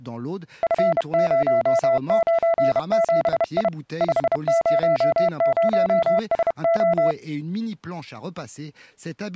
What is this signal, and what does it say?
Morse code, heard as a keyed tone, hand-sent with a bug key, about 31 wpm, 670 Hz, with speech in French. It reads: F097I 500SO